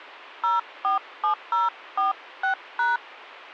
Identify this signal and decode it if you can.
DTMF, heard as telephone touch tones, dialled by hand, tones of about 140 ms. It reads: 047046#